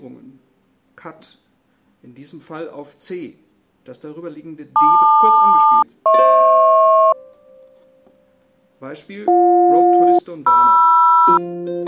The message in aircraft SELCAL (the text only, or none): LQ-HP BJ-MR